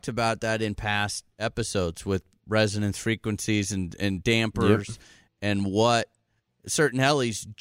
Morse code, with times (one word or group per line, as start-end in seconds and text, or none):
none